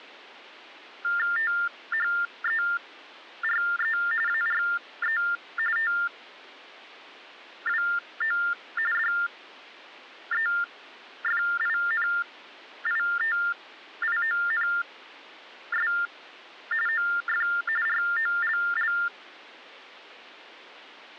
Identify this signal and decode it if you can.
TTY/TDD text telephone tones (45.45 baud Baudot), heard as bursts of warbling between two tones, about 400 Hz shift, 1600 Hz centre. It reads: THERE ARE TWO DEFINITIONS OF ROLL